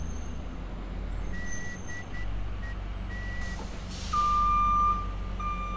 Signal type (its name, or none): Morse code